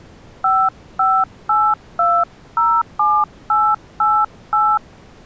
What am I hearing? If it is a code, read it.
DTMF, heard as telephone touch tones, dialled by hand, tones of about 250 ms. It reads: 558207888